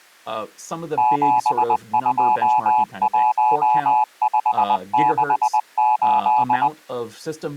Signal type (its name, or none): Morse code